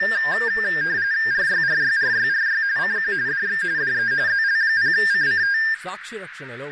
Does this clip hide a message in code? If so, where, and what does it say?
Yes: RTTY (45.45 baud, 170 Hz shift) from 0.0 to 5.7 s, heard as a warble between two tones, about 1700 Hz centre, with radio static, a narrow filter and speech in Telugu. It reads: RYRYRYRY CQ DX DE ZL0CCT